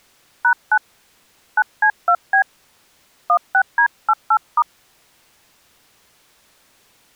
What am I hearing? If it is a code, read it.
DTMF, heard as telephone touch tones, dialled by hand, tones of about 70 ms. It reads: #9 9C2B 16D88*